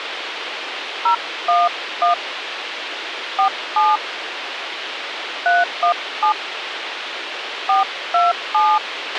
DTMF, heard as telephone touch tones, dialled by hand, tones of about 170 ms, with radio hiss and a squelch burst at the end. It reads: 011 47 317 427